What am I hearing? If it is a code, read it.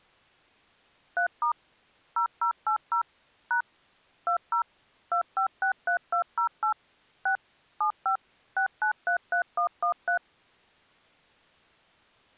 DTMF, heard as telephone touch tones, dialled by machine, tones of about 100 ms. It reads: 3* 0080 # 20 2563208 6 75 6933113